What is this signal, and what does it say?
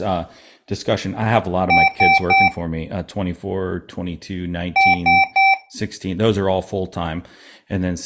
Beep code, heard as beeps from a small speaker, played twice, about 780 Hz, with speech in English. 3 short. In AMI BIOS tables: failure in the first 64 KB of memory; in Dell tables: chipset error.